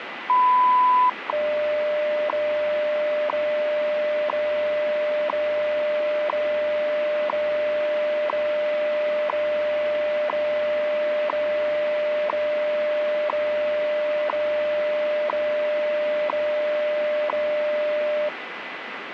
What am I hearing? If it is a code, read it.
Radio time signal (WWV, Colorado), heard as ticks, one a second, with radio static.